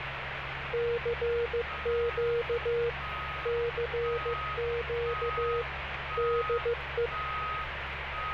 Morse code, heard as a keyed tone, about 15 wpm, 470 Hz, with radio static and street noise. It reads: CQ CQ DE